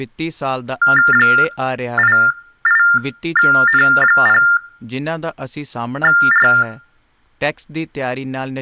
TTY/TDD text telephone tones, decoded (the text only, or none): 88N0R